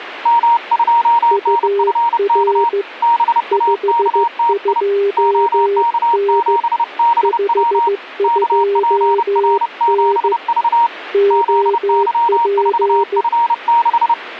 Morse code, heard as two keyed tones. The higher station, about 30 wpm, 940 Hz: M2NFK BAKTI OK7BW KPR7V ZY4F6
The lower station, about 15 wpm, 400 Hz: UR 52N 52N OP